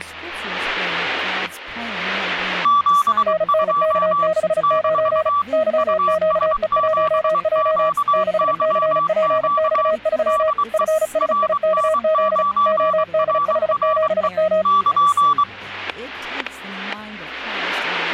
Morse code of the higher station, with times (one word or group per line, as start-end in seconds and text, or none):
2.7-4.3 72
4.6-5.4 -
5.8-9.9 US7QYQ
10.3-10.8 DE
11.2-14.3 RN9RRE
14.7-15.4 <KN>